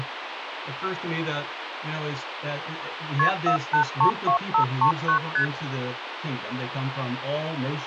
Multi-frequency trunk signalling (R1, as on North American trunks), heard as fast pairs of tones, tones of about 100 ms, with phone line noise. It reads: KP 4832539 ST